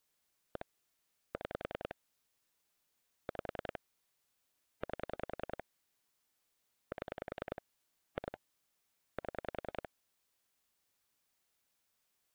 Pulse dialling, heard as clicks on a phone line, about 10 pulses a second. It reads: 1 6 5 8 7 2 7